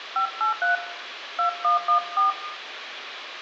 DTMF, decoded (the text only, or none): 583 2114